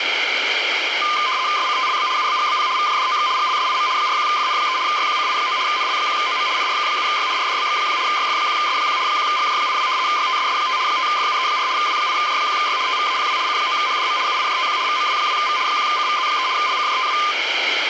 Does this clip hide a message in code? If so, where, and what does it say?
Yes: RTTY (75 baud, 170 Hz shift) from 1.0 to 17.3 s, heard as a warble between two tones, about 1120 Hz centre, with radio static. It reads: SCTLB UBGBP VJDOX GLSIM 41FN3 YQCI9 NL1OM NRK7Y RDBX1 YF1S1 1GJ82 YTSS5 5FUE4 W8J1Y TVAPW C9HDM UIJTQ VMW2V 1CVZ3 LCJTW